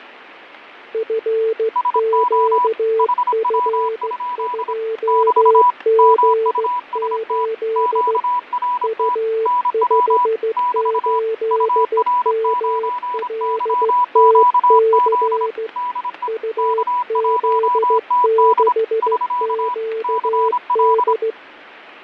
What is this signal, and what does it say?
Morse code, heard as two keyed tones, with radio static, fading and static crashes. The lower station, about 15 wpm, 450 Hz: FQF2G8 U58MLTC UZ6QD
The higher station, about 26 wpm, 980 Hz: SO HW? <BT> MUST QRT NW <BT> UR9YQZ DE K1TD <SK> CL